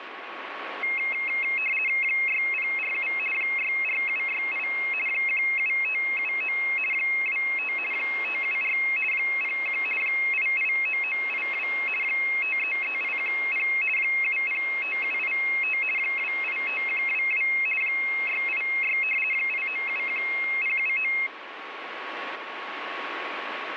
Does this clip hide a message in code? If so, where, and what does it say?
Yes: RTTY (50 baud, 450 Hz shift) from 0.8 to 21.3 s, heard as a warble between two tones, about 2350 Hz centre, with radio static and a steady whistle near 1110 Hz. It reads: 6047 64768 17579 25 574 01 889982 533810 705785 285122 686 8971079